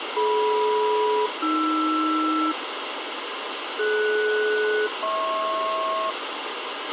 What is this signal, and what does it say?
Aircraft SELCAL, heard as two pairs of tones, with radio hiss, a squelch burst at the end and room echo. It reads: DM-AR DS-HP